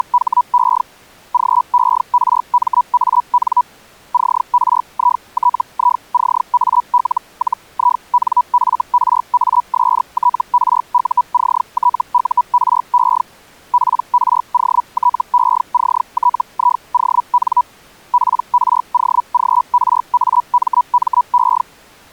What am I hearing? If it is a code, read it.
Hellschreiber (Feld-Hell, 122.5 baud), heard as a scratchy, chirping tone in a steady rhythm, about 980 Hz. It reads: … GERMAN CRITICAL-INFRASTRUCTURE PROTECTION PROGRAMME